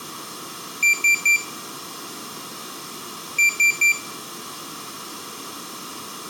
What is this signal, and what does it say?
Beep code, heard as a piezo beeper, played twice, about 2350 Hz, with room echo. 3 short. In AMI BIOS tables: failure in the first 64 KB of memory; in Dell tables: chipset error.